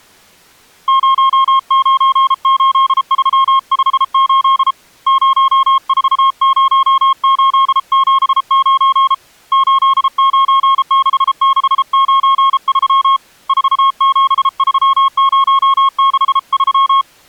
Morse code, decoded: 098358 040879 896693 473063

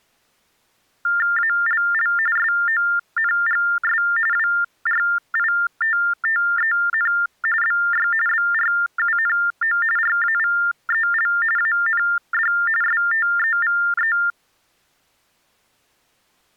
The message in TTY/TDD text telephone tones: ALL SONGS WRITTEN BY BRUNO RAVEL AND STEVE

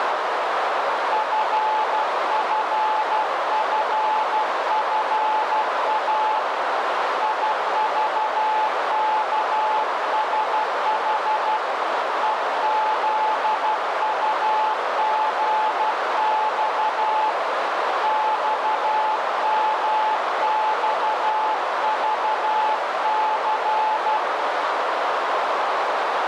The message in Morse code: FFFFA IVKSH EZUGX XMXVC

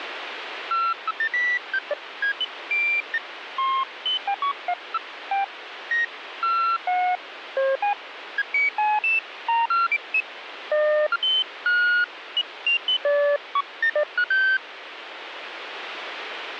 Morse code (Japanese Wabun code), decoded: none

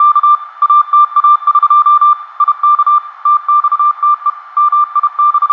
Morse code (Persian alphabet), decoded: … اتاق یک تخته …

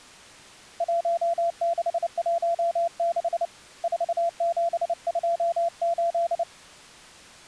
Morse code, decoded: 1616 4728

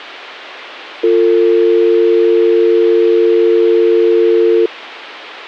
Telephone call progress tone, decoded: dial tone

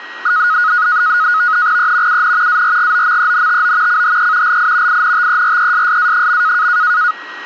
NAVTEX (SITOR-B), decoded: E UN ARGOMENTO CHE LI INTERESSA.

